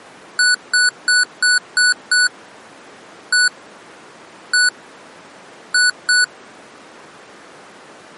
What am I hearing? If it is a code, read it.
Beep code, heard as beeps from a small speaker, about 1480 Hz. 6-1-1-2.